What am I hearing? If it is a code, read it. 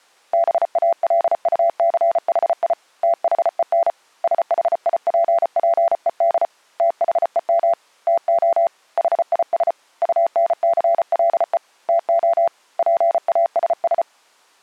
Morse code, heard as a keyed tone, hand-sent with a paddle, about 34 wpm, 680 Hz. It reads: BALUCHI THEN SHIPPED THEM TO HIS UNCLE TO PASS